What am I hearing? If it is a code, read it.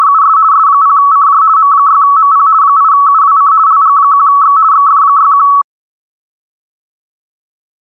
RTTY (50 baud, 170 Hz shift), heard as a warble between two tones, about 1220 Hz centre. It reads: … S0CJ M6MP 8UWC LG1X XF61